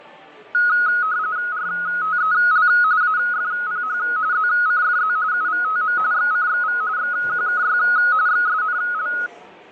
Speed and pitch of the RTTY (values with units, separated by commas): 45.45 baud, 170 Hz shift, 1360 Hz centre